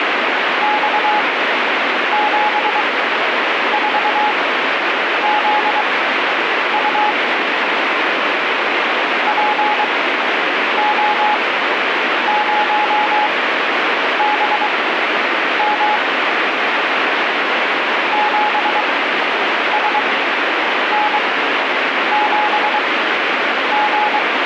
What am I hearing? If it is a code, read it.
Morse code, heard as a keyed tone, machine-sent, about 23 wpm, spaced as for 8 wpm, 840 Hz, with heavy radio static. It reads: X74ZU PO0BM 7SN7G